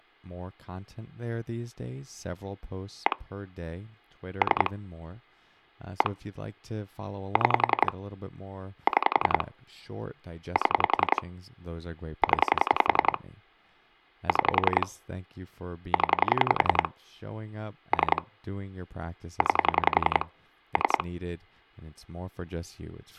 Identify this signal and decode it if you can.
Pulse dialling, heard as clicks on a phone line, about 11 pulses a second, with speech in English. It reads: 1 3 1 6 6 7 0 6 0 3 9 3